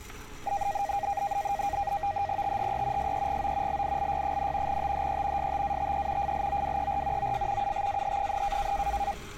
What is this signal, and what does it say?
NAVTEX (SITOR-B), 100 baud, 170 Hz shift, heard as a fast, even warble, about 720 Hz centre, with static crashes and street noise. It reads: THE SEGO LILY, THE STATE FLOWER OF UTAH,